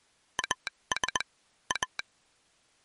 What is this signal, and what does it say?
Morse code, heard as a telegraph sounder, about 20 wpm. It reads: AS A